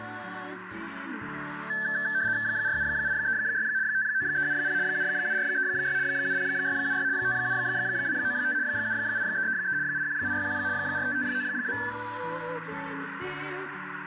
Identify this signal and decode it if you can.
RTTY (75 baud, 170 Hz shift), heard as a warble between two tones, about 1650 Hz centre, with radio static and a narrow filter. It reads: 47836 59370 77436 70676 57295 78333 81861 45592